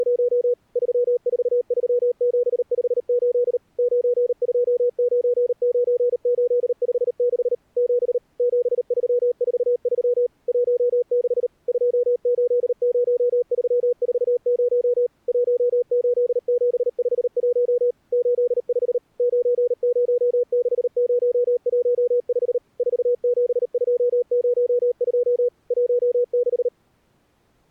Morse code, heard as a keyed tone, machine-sent, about 38 wpm, 490 Hz. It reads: … 343758 9299856 7 7343 16 280340 18751 85 906015 47202 16